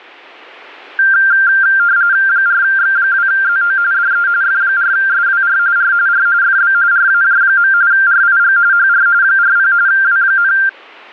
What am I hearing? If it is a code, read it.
RTTY (45.45 baud, 170 Hz shift), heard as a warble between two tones, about 1480 Hz centre. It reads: 4X2ZO DE F4SWR R R FB RAJ. RIG HR 40 W,